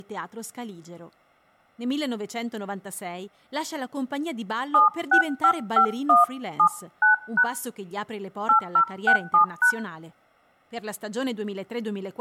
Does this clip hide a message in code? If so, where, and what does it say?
Yes: DTMF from 4.7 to 9.7 s, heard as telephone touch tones, dialled by hand, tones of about 110 ms, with room echo and speech in Italian. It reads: 7655179# 8067#